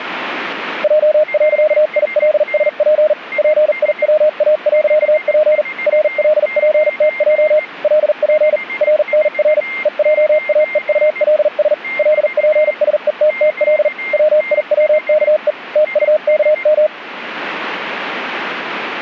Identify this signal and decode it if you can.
Morse code, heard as a keyed tone, machine-sent, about 40 wpm, spaced as for 37 wpm, 620 Hz, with a weaker station near 2110 Hz. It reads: J.ILSP PIWA.P RLPTJ LP RNR EJAEULS LPSETTL WIWKE TUKM